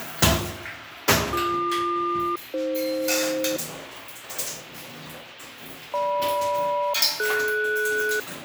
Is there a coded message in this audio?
Yes: aircraft SELCAL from 1.3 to 8.2 s, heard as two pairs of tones, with the noise of a restroom. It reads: BQ-AF GM-DS